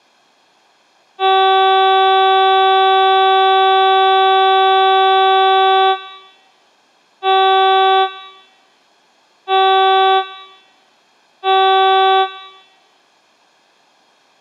Ship horn signal, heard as a ship's horn, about 380 Hz, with room echo. 1 long, 3 short. At sea: a vessel under tow in fog.